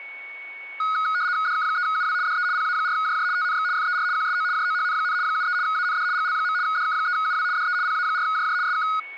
RTTY (75 baud, 170 Hz shift), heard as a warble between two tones, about 1360 Hz centre, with a steady whistle near 2220 Hz. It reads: DK3UW DE PA4JJ TNX FER QSO JOHN, 73 AND GL. DK3UW DE PA4JJ SK